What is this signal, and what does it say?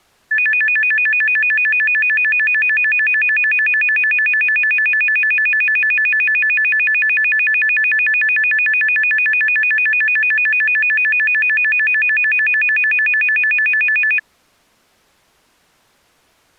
A tone that alternates evenly between two pitches. There is no code.